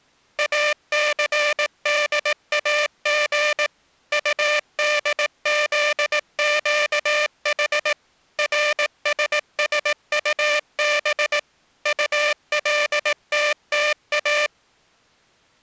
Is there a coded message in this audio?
Yes: Morse code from 0.3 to 14.5 s, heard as a buzzer, machine-sent, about 18 wpm. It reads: ACDAG UDZQH RSSUB ULTTA